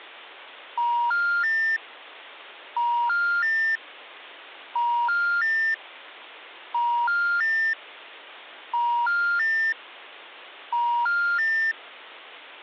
Telephone call progress tone (ITU plan), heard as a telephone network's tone, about 950, 1400, 1800 Hz. Special information tone.